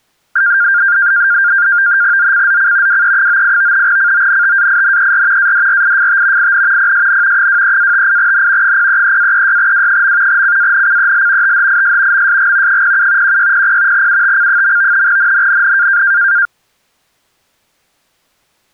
NAVTEX (SITOR-B), 100 baud, 170 Hz shift, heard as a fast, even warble, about 1500 Hz centre. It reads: ZCZC WE98 CONTAINER ADRIFT IN PSN 23-58N 033-36W. CANCEL THIS MSG 07 1600 UTC. NNNN